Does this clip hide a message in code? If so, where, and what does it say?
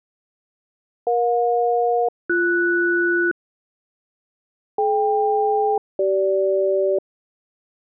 Yes: aircraft SELCAL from 1.1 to 7.0 s, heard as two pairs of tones. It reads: EJ-BS DK-CG